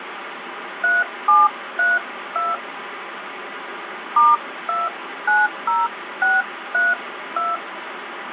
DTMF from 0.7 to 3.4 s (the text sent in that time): 3732